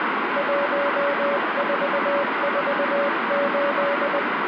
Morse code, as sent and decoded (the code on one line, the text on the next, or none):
.---- ....- ....- ---..
1448